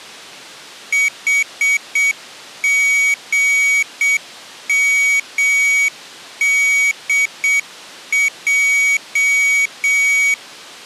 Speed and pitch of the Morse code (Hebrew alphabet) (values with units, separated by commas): 7 wpm, 2250 Hz